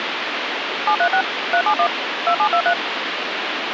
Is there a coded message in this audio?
Yes: DTMF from 0.9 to 2.7 s, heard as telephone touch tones, dialled by machine, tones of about 80 ms, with phone line noise. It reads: 736 371 2723